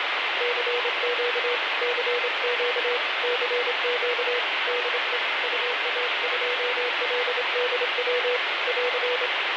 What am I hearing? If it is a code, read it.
Morse code, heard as a keyed tone, hand-sent with a straight key, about 26 wpm, 490 Hz, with heavy radio static. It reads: CQ CQ CQ DE UA2LDW <AR>